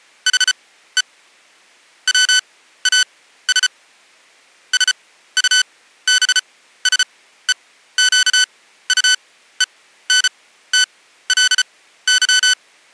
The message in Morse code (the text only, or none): HE WAS SUBSEQUENTLY